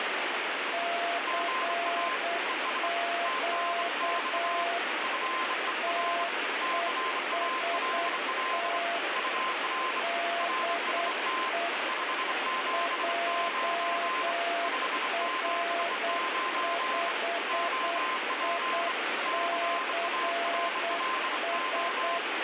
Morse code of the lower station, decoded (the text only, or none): CQ TEST DE JR5ICS